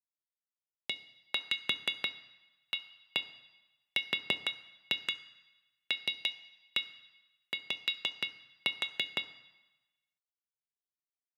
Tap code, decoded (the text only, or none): EARLY